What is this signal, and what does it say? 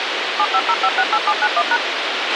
DTMF, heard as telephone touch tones, dialled by machine, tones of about 60 ms, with radio hiss and a squelch burst at the end. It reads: 750568791#